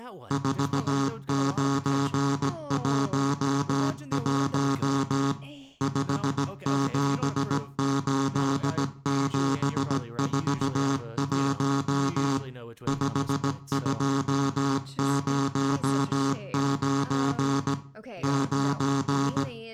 Morse code, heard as a buzzer, machine-sent, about 17 wpm, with room echo and speech in English. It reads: 4911 578741 5209 9